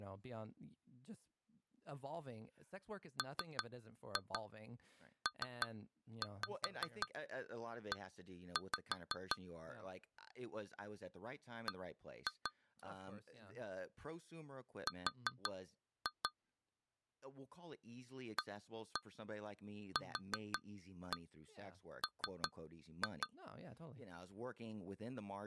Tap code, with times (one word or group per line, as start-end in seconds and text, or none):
3.2-9.4 MPE
11.7-12.5 B
14.9-16.3 R
18.4-23.3 AQM